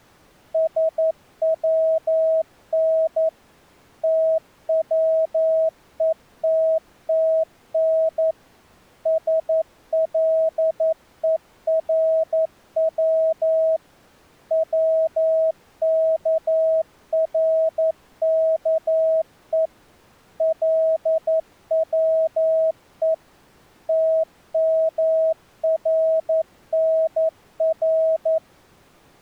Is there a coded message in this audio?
Yes: Morse code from 0.5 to 28.4 s, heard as a keyed tone, machine-sent, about 11 wpm, 640 Hz. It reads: SWN TWETTN SLERW WKRKE LWE TMRNR